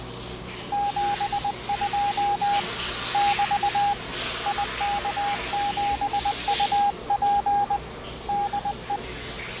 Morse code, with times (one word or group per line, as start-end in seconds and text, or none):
0.7-2.6 72
3.1-3.9 <BT>
4.5-7.8 IK7UP
8.3-9.0 DE